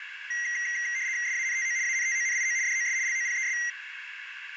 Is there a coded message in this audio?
Yes: RTTY (75 baud, 170 Hz shift) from 0.3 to 3.7 s, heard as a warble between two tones, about 2000 Hz centre, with radio static, a narrow filter and room echo. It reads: SANTO ANTONIO DOS LOPES